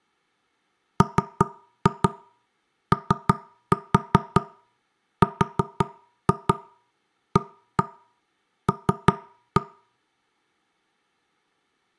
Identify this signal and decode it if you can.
Tap code, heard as knocks on wood, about 5 knocks a second, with room echo. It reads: MORAL